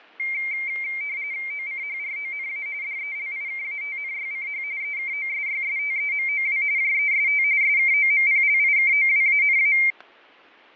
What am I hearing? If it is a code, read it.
RTTY (45.45 baud, 170 Hz shift), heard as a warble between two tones, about 2200 Hz centre, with fading. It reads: OCHRONA DELIKATNYCH EKOSYSTEMOW JEST SKOMPLIKOWANA